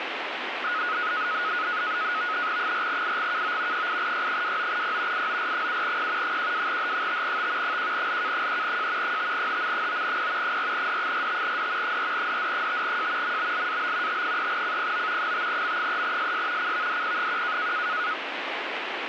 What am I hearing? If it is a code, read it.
NAVTEX (SITOR-B), 100 baud, 170 Hz shift, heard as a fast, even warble, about 1360 Hz centre, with radio static. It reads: 4IGKO 8Y29P IOR7P 12H5T 1LK3J 5HM9P 4D45D 4DD5J MBLAB T3CPO 5M3SS CVDP1